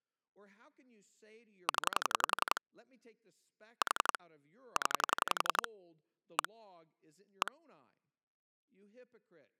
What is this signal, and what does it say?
Pulse dialling, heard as clicks on a phone line, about 11 pulses a second, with speech in English. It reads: 0 4 0 1 1